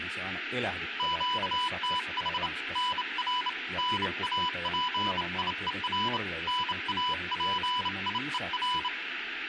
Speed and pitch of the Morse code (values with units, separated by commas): 28 wpm, 990 Hz